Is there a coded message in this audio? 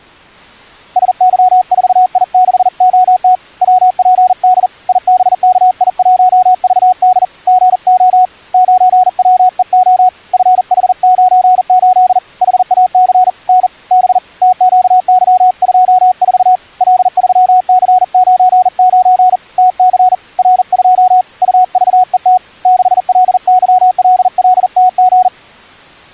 Yes: Morse code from 0.9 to 25.3 s, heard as a keyed tone, hand-sent with a bug key, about 40 wpm, 740 Hz. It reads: SY4I6OT WPD IBKI1VD GO 9WEO FH98 HAC N B TQY24 L3C99 TC R2 UVET 6LYLLTG